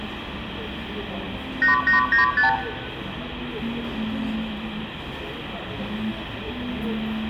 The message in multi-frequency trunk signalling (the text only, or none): 8895